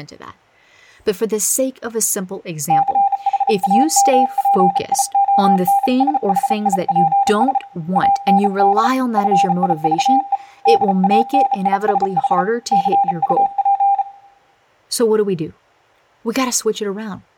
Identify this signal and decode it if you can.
Morse code, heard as a keyed tone, hand-sent with a bug key, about 34 wpm, 800 Hz, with room echo and speech in English. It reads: CHAMPIONSHIPS AND FIVE DANISH CUP